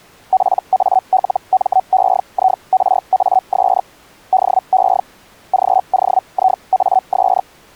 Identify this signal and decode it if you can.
Hellschreiber (Feld-Hell, 122.5 baud), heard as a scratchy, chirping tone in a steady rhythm, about 750 Hz. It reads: PALMEIRAS DE GOIAS